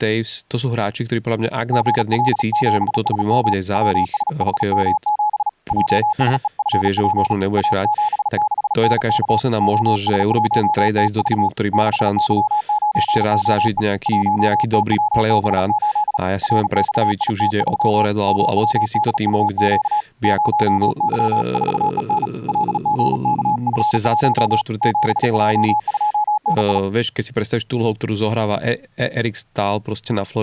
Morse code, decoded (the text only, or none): GL7SM WSHM7 JSEFP A76NK OS1TV 6Y9OE 1TWB8 RXIT3 MWDUQ 0Y4EN LGKF1 7J2NI